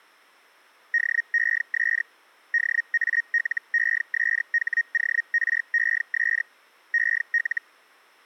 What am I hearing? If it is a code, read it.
Hellschreiber (Feld-Hell, 122.5 baud), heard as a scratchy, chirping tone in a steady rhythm, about 1850 Hz. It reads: DES DALESHORES EL